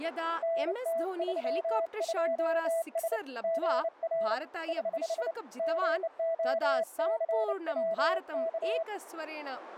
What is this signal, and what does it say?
Morse code, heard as a keyed tone, hand-sent with a bug key, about 29 wpm, 660 Hz, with radio static and speech in Sanskrit. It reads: NT32S GR <HH> GOCWK